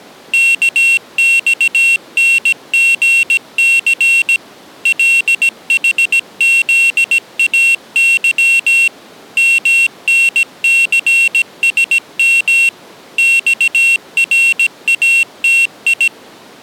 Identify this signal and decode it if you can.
Morse code, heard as a high beeper, machine-sent, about 17 wpm, 2700 Hz. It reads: KXNGC LHZAY MNCSM XRATI